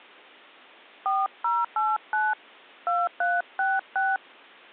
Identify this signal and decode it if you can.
DTMF, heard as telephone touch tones, dialled by hand, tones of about 200 ms. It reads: 4089 2366